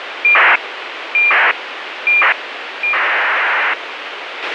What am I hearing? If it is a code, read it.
ACARS aircraft data, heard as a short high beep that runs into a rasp, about 2400 baud, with radio hiss and a squelch burst at the end.